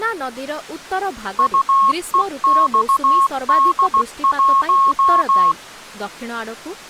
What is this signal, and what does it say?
Morse code, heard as a keyed tone, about 16 wpm, 1090 Hz, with speech in Odia. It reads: UEXD1